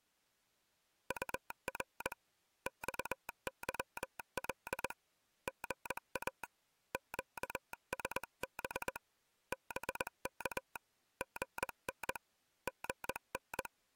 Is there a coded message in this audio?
Yes: Morse code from 1.0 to 13.7 s, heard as a telegraph sounder, hand-sent with a straight key, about 20 wpm. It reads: UR XYL GA QSB BK GN GN